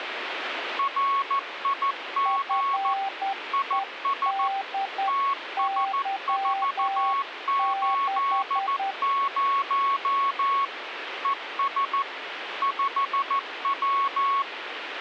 Morse code, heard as two keyed tones, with radio static. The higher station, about 14 wpm, 1100 Hz: RIG IS TS480 ES 5W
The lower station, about 10 wpm, 780 Hz: FEDY6